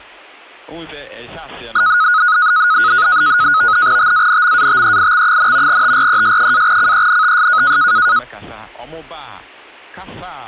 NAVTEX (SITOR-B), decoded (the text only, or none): TANMATEIX, TRES-CENTS